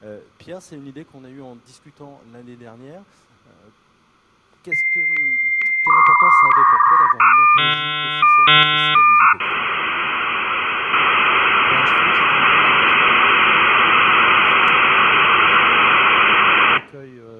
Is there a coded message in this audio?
Yes: dial-up modem handshake (V.34 or later) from 4.7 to 16.8 s, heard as a whistle, warbles, then hiss.